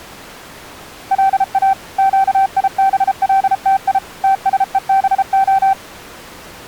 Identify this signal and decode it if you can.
Morse code (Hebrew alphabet), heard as a keyed tone, machine-sent, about 33 wpm, 780 Hz. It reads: לא קיבלתי תשובה